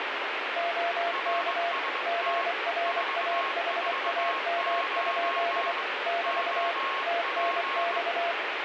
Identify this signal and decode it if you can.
Morse code, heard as two keyed tones, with heavy radio static. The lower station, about 24 wpm, 690 Hz: OK GRAHAM? <BT> TNX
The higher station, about 21 wpm, 1090 Hz: RST 449 OP